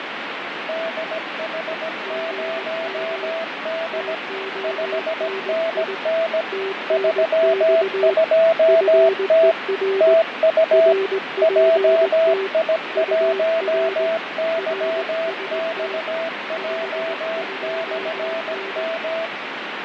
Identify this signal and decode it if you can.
Morse code, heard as two keyed tones, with radio static and fading. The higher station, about 17 wpm, 660 Hz: DH0D 5NN 32T TU JI1YXJ/M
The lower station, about 19 wpm, 390 Hz: GM TONI TNX FER RPT UR RST 52N